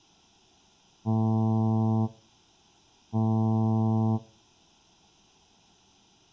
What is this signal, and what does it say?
Ship horn signal, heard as a ship's horn, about 110 Hz, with room echo. 2 short. At sea: I am altering course to port.